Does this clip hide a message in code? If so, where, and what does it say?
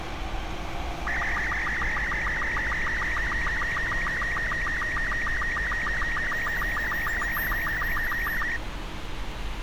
Yes: SSTV (slow-scan television), Robot 36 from 1.1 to 8.6 s, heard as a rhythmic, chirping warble, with radio hiss and street noise.